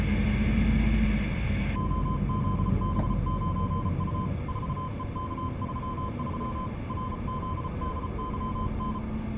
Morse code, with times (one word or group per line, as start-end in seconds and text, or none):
1.8-4.3 OZB9U
4.5-6.7 4EK33
6.9-9.0 RZDYN